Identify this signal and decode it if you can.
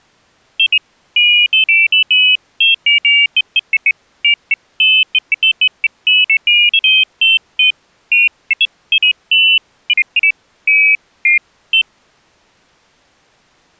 Pairs of high tones at irregular times. There is no code.